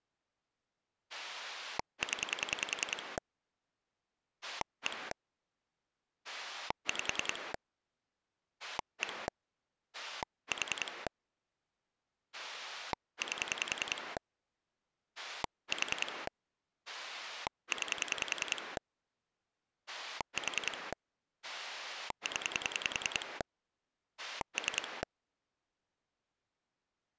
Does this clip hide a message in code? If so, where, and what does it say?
Yes: pulse dialling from 1.1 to 25.0 s, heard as a rotary dial, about 10 pulses a second. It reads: 0 1 5 1 4 8 4 9 4 0 3